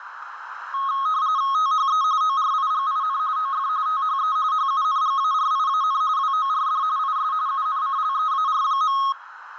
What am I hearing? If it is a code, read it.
RTTY (45.45 baud, 170 Hz shift), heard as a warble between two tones, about 1180 Hz centre, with radio static and a narrow filter. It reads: THE ORIGIN OF THE HUNGARIAN WORD IS UNCLEAR.